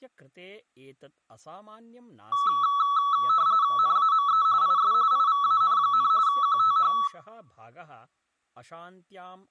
RTTY (45.45 baud, 170 Hz shift), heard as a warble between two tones, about 1220 Hz centre, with speech in Sanskrit. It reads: NAME IS IVAN, QTH